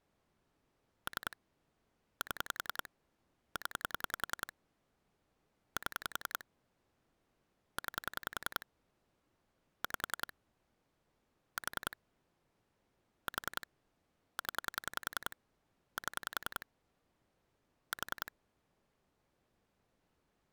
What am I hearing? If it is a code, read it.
Pulse dialling, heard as clicks on a phone line, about 10 pulses a second. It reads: 3 7 0 7 9 5 4 4 0 7 4